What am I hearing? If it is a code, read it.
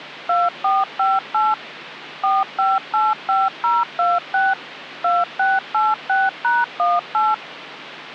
DTMF, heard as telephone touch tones, dialled by machine, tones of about 200 ms, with phone line noise. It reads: 2458 4585026 2686#18